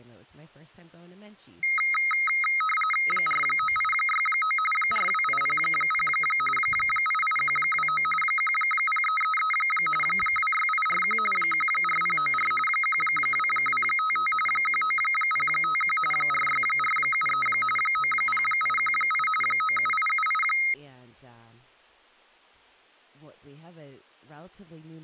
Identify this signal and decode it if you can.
RTTY (45.45 baud, 850 Hz shift), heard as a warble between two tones, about 1700 Hz centre, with speech in English. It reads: 49869 42800 88129 10333 26841 14094 12255 19051 46473 90818 97878